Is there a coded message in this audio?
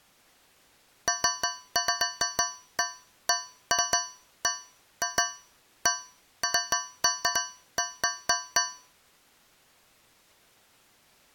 No, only irregular taps on a metal pipe.